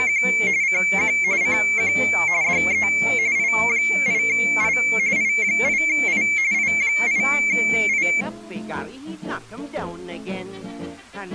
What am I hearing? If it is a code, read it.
RTTY (45.45 baud, 170 Hz shift), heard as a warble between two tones, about 2250 Hz centre. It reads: … CQ CQ DE I8I I8I I8I